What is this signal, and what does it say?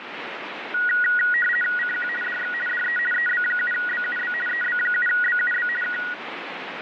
RTTY (50 baud, 450 Hz shift), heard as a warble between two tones, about 1700 Hz centre, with radio static. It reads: CQ DX DE EB7BUB EB7BUB K